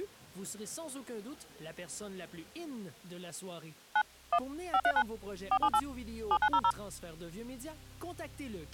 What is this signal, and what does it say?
DTMF, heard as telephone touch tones, dialled by machine, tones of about 60 ms. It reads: 9 1 539 478 7900